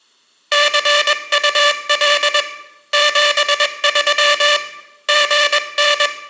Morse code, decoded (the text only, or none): CUL 73 GN